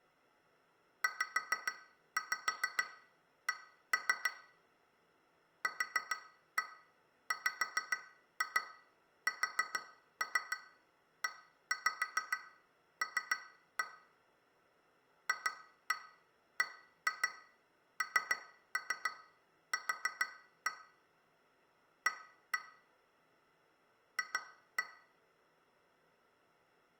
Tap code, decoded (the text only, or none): ZC QWSEL FBNQ A F